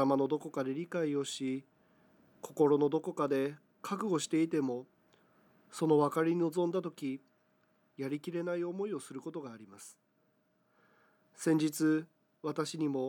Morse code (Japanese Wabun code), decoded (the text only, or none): none